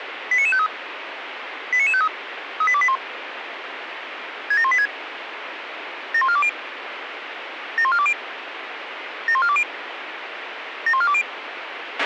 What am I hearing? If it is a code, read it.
Five-tone selective call (ZVEI), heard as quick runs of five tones, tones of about 70 ms, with radio hiss and a squelch burst at the end. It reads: 89953 89953 38281 67186 71420 71420 71420 71420